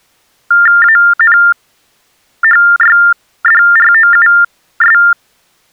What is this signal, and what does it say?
TTY/TDD text telephone tones (45.45 baud Baudot), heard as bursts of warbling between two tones, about 400 Hz shift, 1600 Hz centre. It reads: ANHYDROUS